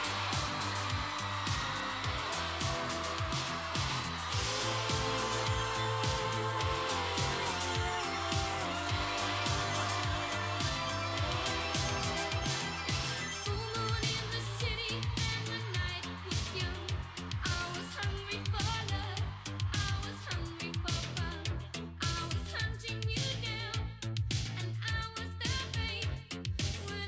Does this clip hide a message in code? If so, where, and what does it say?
No.